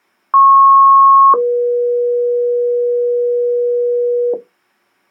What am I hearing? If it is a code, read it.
Two-tone page, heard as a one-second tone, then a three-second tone, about 1090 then 480 Hz.